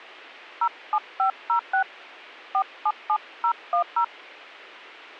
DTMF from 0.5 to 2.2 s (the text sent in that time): 07506